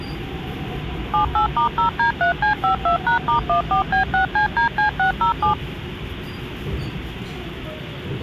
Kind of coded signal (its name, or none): DTMF